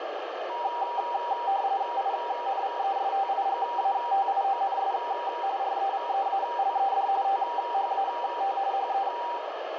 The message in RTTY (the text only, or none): INVESTIGATIONS REVEALED THAT HE